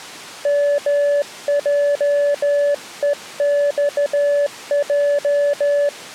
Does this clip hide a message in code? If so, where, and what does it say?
Yes: Morse code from 0.4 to 5.9 s, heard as a keyed tone, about 14 wpm, 580 Hz. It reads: MJEXJ